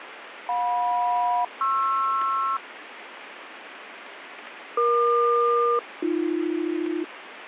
Aircraft SELCAL, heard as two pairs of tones, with radio static. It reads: JM-PR EQ-AB